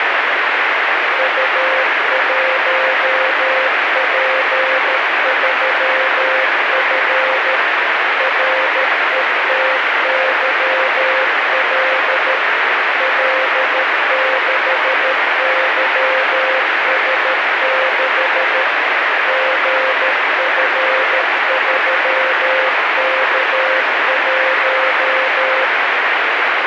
Morse code, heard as a keyed tone, machine-sent, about 13 wpm, 520 Hz, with heavy radio static. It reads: U1P3F RETYL L6YS6 GF3K1